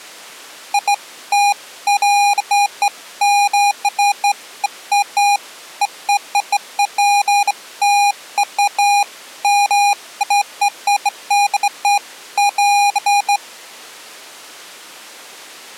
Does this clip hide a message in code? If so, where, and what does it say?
No, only beeps of irregular length.